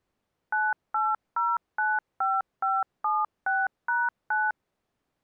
DTMF, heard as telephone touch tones, dialled by machine, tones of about 200 ms. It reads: 98095576#9